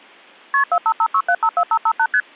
Multi-frequency trunk signalling (R1, as on North American trunks), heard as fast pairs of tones, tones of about 60 ms. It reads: KP 4556754558 ST